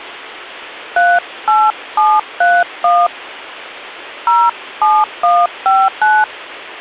DTMF, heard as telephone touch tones, dialled by hand, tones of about 230 ms. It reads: 38731 07159